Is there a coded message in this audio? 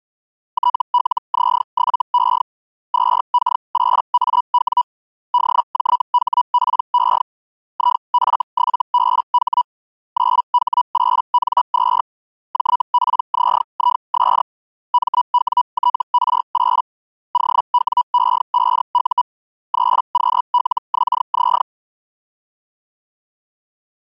Yes: Hellschreiber (Feld-Hell, 122.5 baud) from 0.5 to 21.6 s, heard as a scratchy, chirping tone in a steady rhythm, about 980 Hz. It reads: TLZ7E 2K8AW DJHPE IF7BH 9H8N2 JPZIS MWTR8 OWE5U 3QLXZ